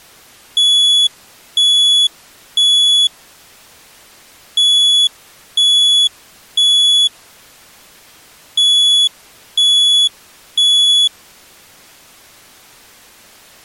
Alarm pattern, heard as an alarm's beeps, played three times, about 3400 Hz. Temporal three. Smoke or fire, evacuate.